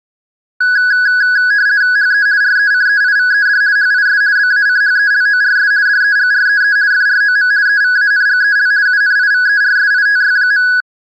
RTTY (50 baud, 170 Hz shift), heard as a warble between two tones, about 1550 Hz centre. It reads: HE RECEIVED HIS BACHELORS DEGREE FROM EVANGEL UNIVERSITY.